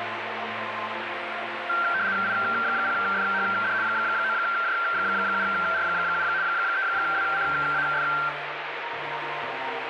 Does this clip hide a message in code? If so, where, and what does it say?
Yes: RTTY (75 baud, 170 Hz shift) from 1.7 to 8.3 s, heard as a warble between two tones, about 1470 Hz centre, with radio static. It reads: I0FHD 9J7R7 3WCAF